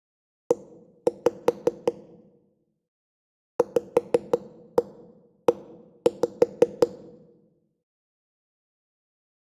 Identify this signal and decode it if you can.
Tap code, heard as knocks on wood, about 5 knocks a second, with room echo. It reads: E VE